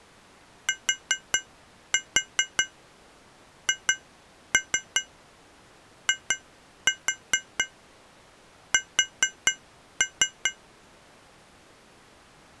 Tap code, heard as taps on glass, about 4 knocks a second. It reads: THIS